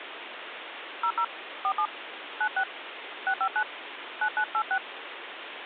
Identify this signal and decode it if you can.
DTMF, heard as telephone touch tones, dialled by hand, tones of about 70 ms, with phone line noise. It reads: 00 47 96 659 9986